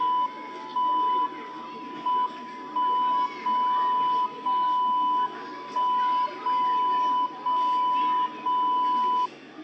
Radio time signal (WWVB), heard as a tone whose level steps once a second, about 1000 Hz, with the noise of a park. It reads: 1 M 1 0 0 1 0 0 0